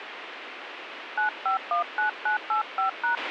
DTMF, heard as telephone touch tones, dialled by hand, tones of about 120 ms, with radio hiss and a squelch burst at the end. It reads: 9519985#